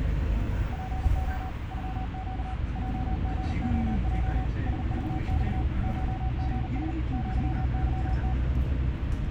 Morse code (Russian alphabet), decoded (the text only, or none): ПО ЮЩ ЙГОЙ СЖЬ ШГС ЪЫТ